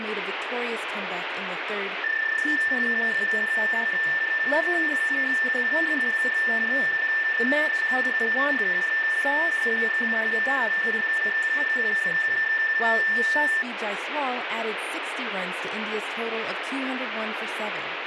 PSK31 (31.25 baud), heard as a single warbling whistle, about 1800 Hz, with radio static and speech in English.